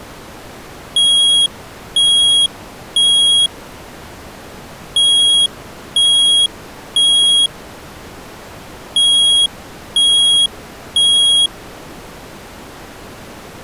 Alarm pattern, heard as an alarm's beeps, played three times, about 3300 Hz. Temporal three. Smoke or fire, evacuate.